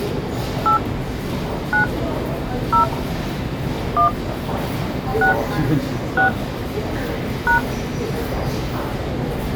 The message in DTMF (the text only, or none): 8 9 0 1 6 6 #